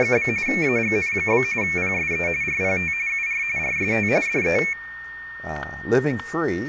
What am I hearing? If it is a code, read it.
RTTY (45.45 baud, 170 Hz shift), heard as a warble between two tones, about 2300 Hz centre, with static crashes and a steady whistle near 1830 Hz. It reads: … AGN? PSE RPT UR RST DE